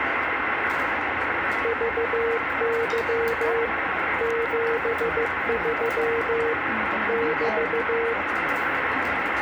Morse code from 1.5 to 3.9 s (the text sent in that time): VY